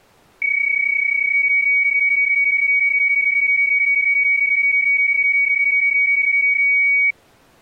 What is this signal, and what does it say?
PSK31 (31.25 baud), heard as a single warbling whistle, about 2250 Hz.